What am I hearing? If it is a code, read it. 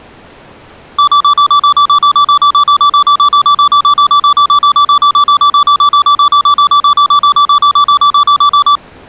Evenly repeated beeps. There is no code.